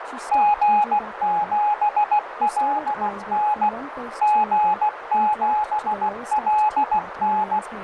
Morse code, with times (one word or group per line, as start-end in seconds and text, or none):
0.3-3.7 G7LN
4.2-7.6 G7LN